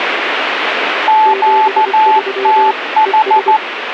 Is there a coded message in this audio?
Yes: Morse code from 1.0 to 3.6 s, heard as two keyed tones, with radio static. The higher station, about 14 wpm, 870 Hz: QTH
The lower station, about 24 wpm, 390 Hz: 73 ES